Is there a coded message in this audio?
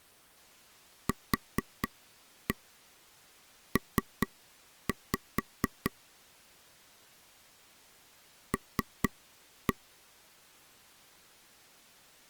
Yes: tap code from 1.1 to 9.7 s, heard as taps on a table, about 4 knocks a second. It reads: QP L